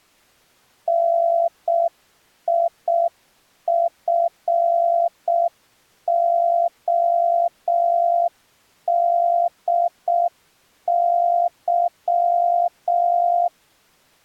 Morse code, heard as a keyed tone, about 6 wpm, 690 Hz. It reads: NIFODY